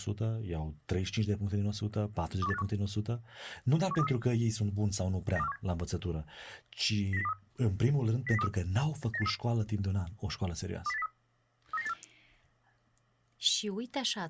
Five-tone selective call (EEA), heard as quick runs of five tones, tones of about 40 ms, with speech in Romanian. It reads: 21851 17233 92417 09023 09023 98833 20803 39984